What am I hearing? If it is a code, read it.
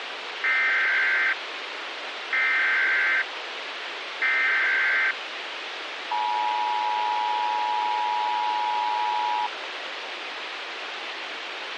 Emergency Alert System (SAME) tones (header bursts, then the 853 and 960 Hz attention tone), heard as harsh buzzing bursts, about 520.83 baud, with radio hiss.